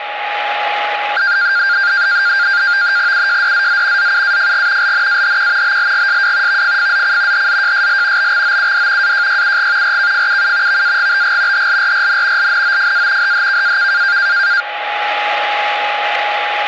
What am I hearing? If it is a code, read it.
NAVTEX (SITOR-B), 100 baud, 170 Hz shift, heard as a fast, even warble, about 1500 Hz centre, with radio static and a steady whistle near 830 Hz. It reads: UJDZZ ZUAFG LNAHQ BLGSW VFFZC HZJSL BXOUD AJYUG RKFUU VAGBG HLRRN LNOFA HHKAK